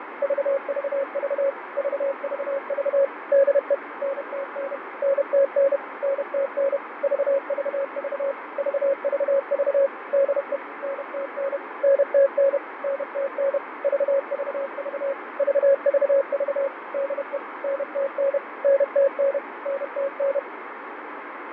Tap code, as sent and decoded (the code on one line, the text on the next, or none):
none